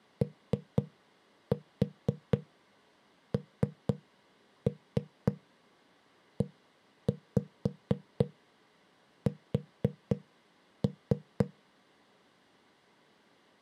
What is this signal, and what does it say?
Tap code, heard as knocks on a wall, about 3 knocks a second. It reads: ONES